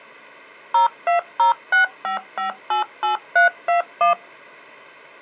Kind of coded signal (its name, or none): DTMF